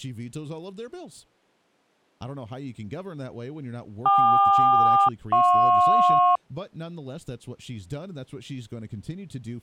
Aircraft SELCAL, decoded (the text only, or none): KQ-JP